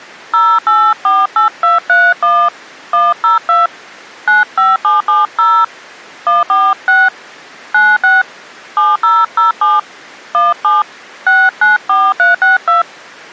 DTMF, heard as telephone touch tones, dialled by hand, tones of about 190 ms. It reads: 0848231 102 95770 146 96 7007 17 694362